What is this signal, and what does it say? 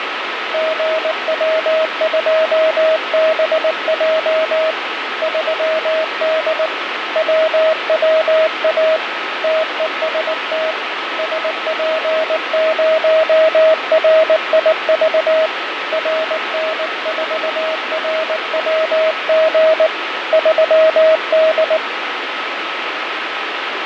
Morse code, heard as a keyed tone, hand-sent with a paddle, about 19 wpm, 640 Hz, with radio static and fading. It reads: GW2BJ 3D WWA TEST SP0RIV RN4RWG 3D